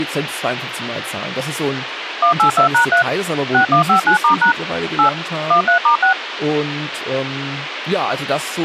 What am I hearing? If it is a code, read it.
DTMF, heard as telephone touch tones, dialled by machine, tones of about 100 ms, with radio hiss and speech in German. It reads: 182#3 6159*# 8 13*6